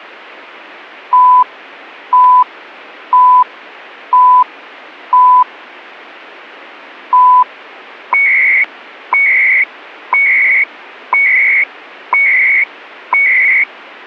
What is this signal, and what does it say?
Radio time signal (CHU, Canada), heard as beeps and data bursts, one a second.